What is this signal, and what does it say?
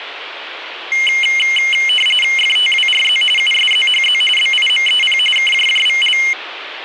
RTTY (45.45 baud, 850 Hz shift), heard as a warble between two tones, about 2550 Hz centre, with radio static. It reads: FTWRZ USZHZ BIMEP KJJVL